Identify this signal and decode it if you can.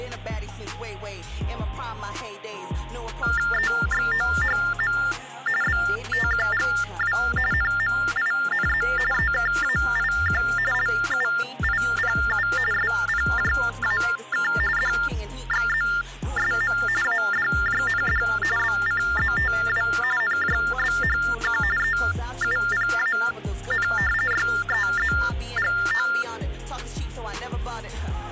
TTY/TDD text telephone tones (45.45 baud Baudot), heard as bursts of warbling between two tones, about 400 Hz shift, 1600 Hz centre. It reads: EXOHM BTQGW NMINZ EKAIQ LUIPU SPJAK DXZSM ADJND BCZTW NJBHQ EUPAN YEZGO